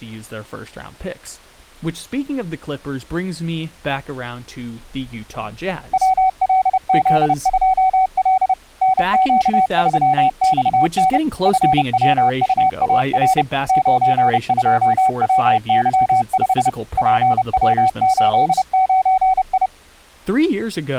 Morse code, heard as a keyed tone, machine-sent, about 30 wpm, 760 Hz, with speech in English. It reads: WLZ2L NQ3XN FWUAR 92WY5 PW89I